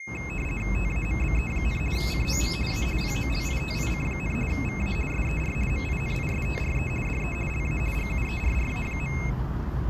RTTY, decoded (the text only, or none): TAMBE, COM A POLITIC, VA SER MINISTRE DE LA GUERRA.